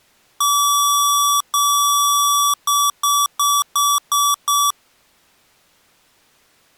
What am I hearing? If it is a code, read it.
Beep code, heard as beeps from a small speaker, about 1150 Hz. 2 long, 6 short.